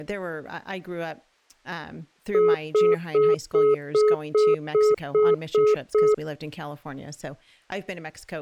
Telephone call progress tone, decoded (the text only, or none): congestion tone